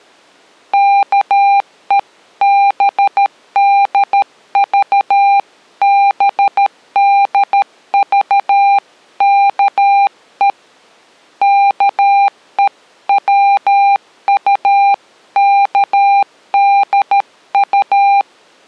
Morse code (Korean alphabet), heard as a keyed tone, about 13 wpm, 800 Hz. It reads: 아들들아 아비의